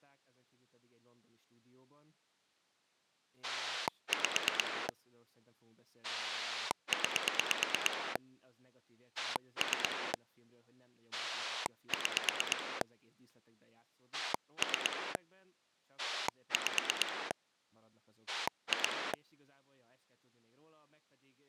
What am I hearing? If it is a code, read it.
Pulse dialling, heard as a rotary dial, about 9 pulses a second, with speech in Hungarian. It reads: 5 9 3 6 3 5 2